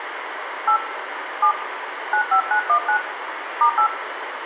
DTMF, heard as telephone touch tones, dialled by hand, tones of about 90 ms, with phone line noise and room echo. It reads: 8 7 95919 *8